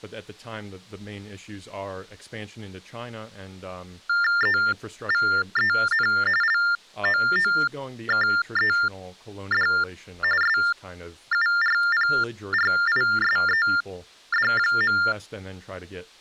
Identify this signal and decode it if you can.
TTY/TDD text telephone tones (45.45 baud Baudot), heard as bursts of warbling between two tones, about 400 Hz shift, 1600 Hz centre, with speech in English. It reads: EVEN LOOKED SURPRISED.